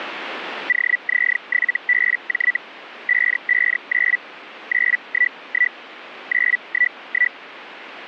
Hellschreiber (Feld-Hell, 122.5 baud), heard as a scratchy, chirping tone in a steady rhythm, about 1950 Hz. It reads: OZ7BJ 559 911 911